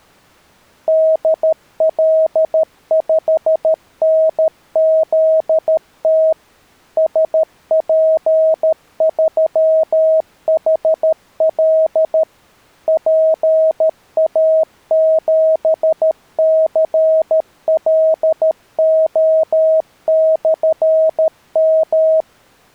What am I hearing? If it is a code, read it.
Morse code, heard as a keyed tone, machine-sent, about 13 wpm, 640 Hz. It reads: DL5NZT SP3HL PA7CLO/M